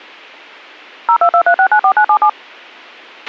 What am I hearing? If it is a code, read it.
DTMF, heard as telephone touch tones, dialled by machine, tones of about 80 ms, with a squelch burst at the end. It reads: 0223694977